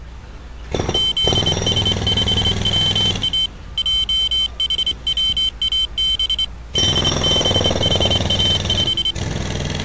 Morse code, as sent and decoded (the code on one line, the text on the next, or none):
--.. ... ..... .-- .- / .--- .... .-- .- -... / -.. -... .... .- .....
ZS5WA JHWAB DBHA5